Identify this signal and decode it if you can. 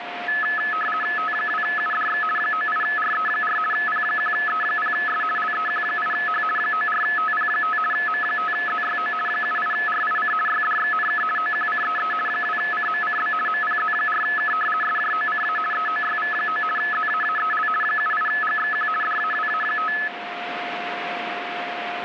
RTTY (50 baud, 450 Hz shift), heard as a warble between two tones, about 1500 Hz centre, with radio static and a steady whistle near 710 Hz. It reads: T2UDX 98RE4 P1E0S LEQ8H 94TP5 M5ZYO 78RIC YDXNK OQCEE 2CMCB MPZ4K SJOCA EOYV9 ZAAEL 78GXQ DAWA5